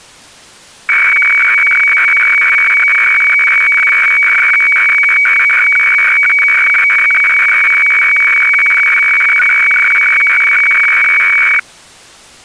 Weather fax (radiofax), 120 lines a minute, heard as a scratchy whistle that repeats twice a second.